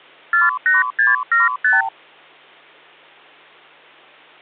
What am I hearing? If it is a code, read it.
Multi-frequency trunk signalling (R2, with the far end's replies), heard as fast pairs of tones, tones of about 160 ms. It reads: 48675